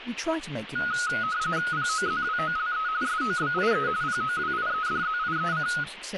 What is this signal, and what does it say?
RTTY (45.45 baud, 170 Hz shift), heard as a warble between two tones, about 1360 Hz centre, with radio static and speech in English. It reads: POZWOLE SOBIE POWIEDZIEC